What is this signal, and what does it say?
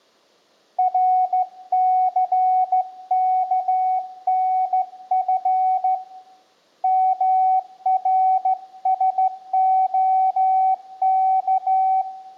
Morse code, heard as a keyed tone, hand-sent with a straight key, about 14 wpm, 750 Hz, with room echo. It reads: RCKNF MRSOK